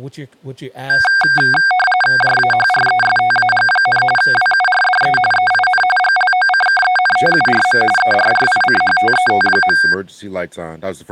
RTTY (45.45 baud, 850 Hz shift), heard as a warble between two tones, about 1160 Hz centre, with speech in English. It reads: JAHRESTAG, WURDE EIN GLOCKENTURM ERRICHTET.